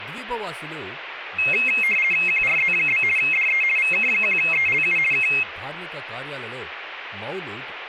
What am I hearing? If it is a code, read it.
RTTY (50 baud, 450 Hz shift), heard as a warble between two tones, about 2350 Hz centre, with radio static and speech in Telugu. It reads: QRZ? DE VK1ELU K